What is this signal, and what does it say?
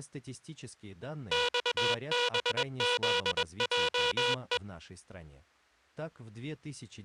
Morse code, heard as a buzzer, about 21 wpm. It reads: XBZJE